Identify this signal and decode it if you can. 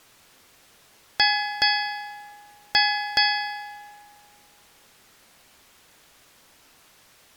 Ship's bell, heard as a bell. 4. Four half-hours of the watch have passed.